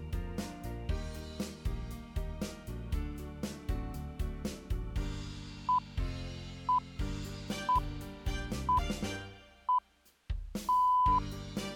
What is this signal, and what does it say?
Radio time signal (six pips, as the Greenwich Time Signal), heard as pips.